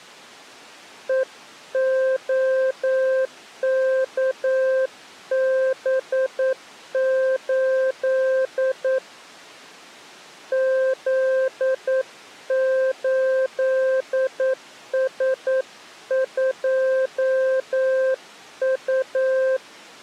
Morse code, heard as a keyed tone, hand-sent with a paddle, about 9 wpm, 520 Hz. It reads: EOKB8 Z8S2U